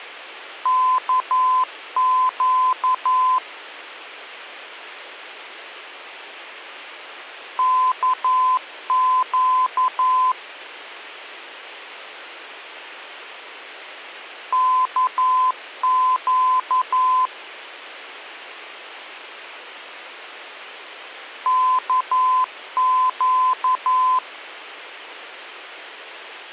Morse code, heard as a keyed tone, machine-sent, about 11 wpm, 1020 Hz. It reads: KQ KQ KQ KQ